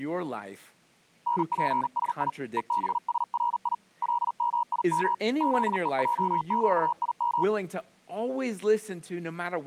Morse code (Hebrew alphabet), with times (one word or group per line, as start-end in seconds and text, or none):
1.3-2.3 נפשי
2.6-3.7 ובשרי
4.0-5.1 למים
5.4-7.4 זועקים